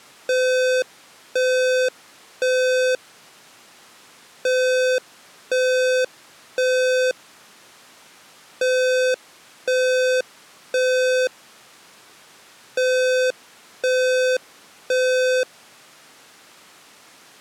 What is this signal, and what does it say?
Alarm pattern, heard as an alarm's beeps, played four times, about 510 Hz. Temporal three. Smoke or fire, evacuate.